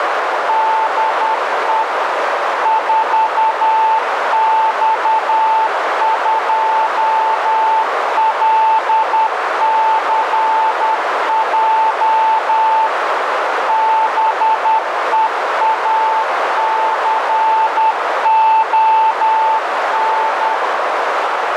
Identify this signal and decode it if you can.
Morse code, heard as a keyed tone, machine-sent, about 10 wpm, 880 Hz, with heavy radio static and a narrow filter. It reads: DE 4X2LCJ BEACON